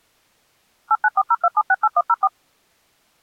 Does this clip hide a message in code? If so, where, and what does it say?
Yes: DTMF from 0.9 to 2.3 s, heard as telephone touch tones, dialled by machine, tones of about 50 ms. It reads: 89402768104